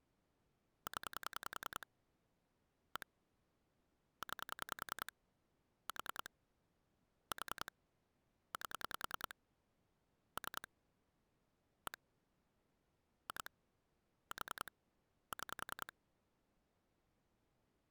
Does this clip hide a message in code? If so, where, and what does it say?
Yes: pulse dialling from 0.9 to 15.9 s, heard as clicks on a phone line, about 10 pulses a second. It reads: 0 1 9 4 4 8 3 1 2 4 6